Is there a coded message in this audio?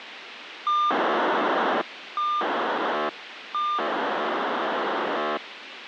Yes: POCSAG pager data (2400 baud) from 0.7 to 5.4 s, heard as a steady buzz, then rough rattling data, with radio hiss.